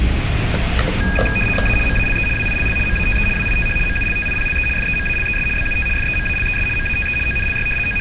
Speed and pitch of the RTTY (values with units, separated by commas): 75 baud, 850 Hz shift, 2050 Hz centre